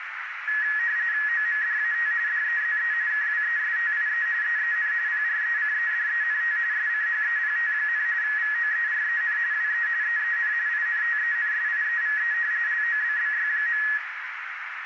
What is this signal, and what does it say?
RTTY (45.45 baud, 170 Hz shift), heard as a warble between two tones, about 1800 Hz centre, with radio static and a narrow filter. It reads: OMDAT DEZE KWESTIE EEN PRECEDENT SCHEPT, VOEREN WE EEN INTENSIEVE LOBBY.